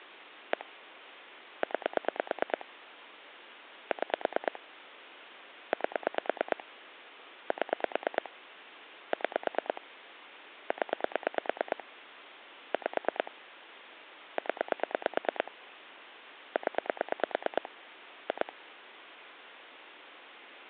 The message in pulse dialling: 1 9 6 8 7 6 0 5 0 0 2

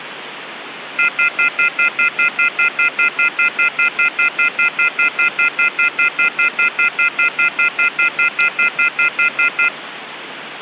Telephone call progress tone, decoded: off-hook warning tone

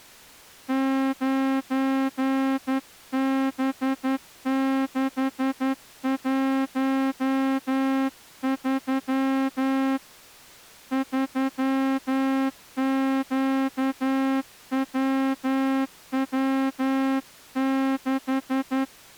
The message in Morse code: 9B613 3QWW6

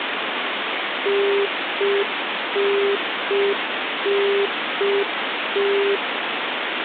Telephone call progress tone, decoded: congestion tone

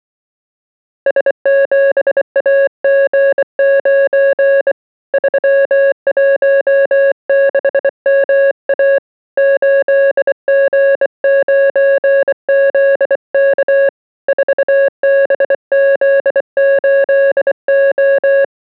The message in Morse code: S7AG9 316MA 8G9ZK 4BZ8O

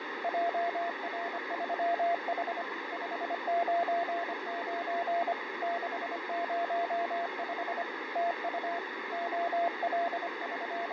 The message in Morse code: JR3H 599 605 TU …

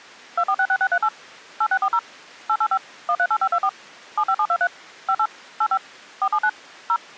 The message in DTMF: 2466638 8640 885 138524 75723 58 85 479 0

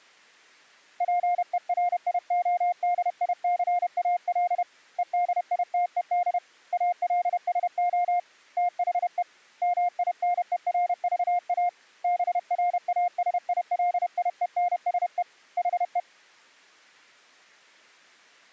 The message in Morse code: PERIODICAL EDITED ALSO THE MINERVA BRASILIENSE HE

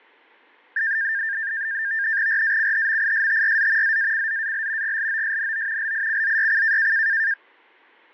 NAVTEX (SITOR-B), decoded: RACHMISTRZ ZACZAL GLOSNO LICZYC

